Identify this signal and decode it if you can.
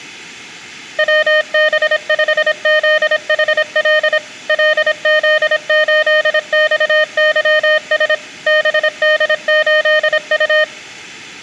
Morse code, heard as a keyed tone, machine-sent, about 26 wpm, 610 Hz, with room echo. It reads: WB5ZHL LZ8XYS BD8U